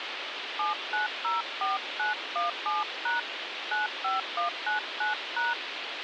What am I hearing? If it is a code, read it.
DTMF, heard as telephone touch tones, dialled by hand, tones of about 140 ms, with radio hiss. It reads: 7904917# 95199#